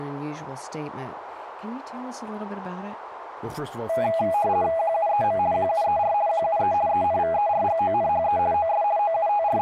RTTY (50 baud, 170 Hz shift), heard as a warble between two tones, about 740 Hz centre, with radio static, a narrow filter and speech in English. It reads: QUEM QUER QUE ENVERGONHE OS …